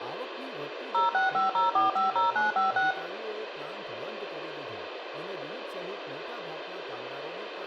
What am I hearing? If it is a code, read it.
DTMF, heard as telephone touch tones, dialled by machine, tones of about 150 ms, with radio hiss, room echo and speech in Gujarati. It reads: 0650450956